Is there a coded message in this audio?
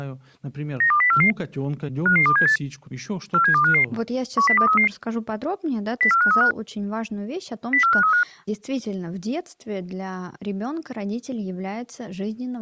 Yes: five-tone selective call (CCIR) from 0.8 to 8.2 s, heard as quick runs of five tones, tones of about 100 ms, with speech in Russian. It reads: 92044 55278 47255 10233 04535 04535